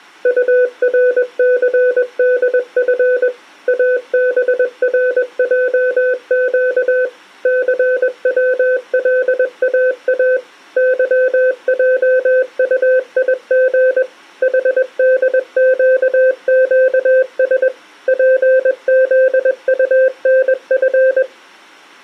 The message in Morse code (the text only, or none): URCDF ABRJQ CWLAA YJUIG HDQQS PZUNF